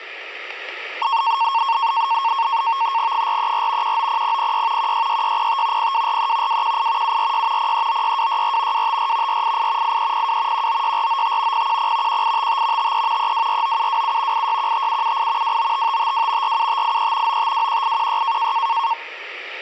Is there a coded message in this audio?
Yes: NAVTEX (SITOR-B), 100 baud, 170 Hz shift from 1.0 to 18.9 s, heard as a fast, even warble, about 1000 Hz centre. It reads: 434 190006 166605 0243 218 746 0396264 254 488 8302 196495 010 1855 53 3249727 8615778 295552 47583 9521816